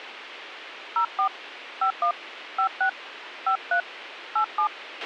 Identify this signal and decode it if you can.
DTMF, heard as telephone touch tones, dialled by hand, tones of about 90 ms, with radio hiss and a squelch burst at the end. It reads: 04 51 56 53 87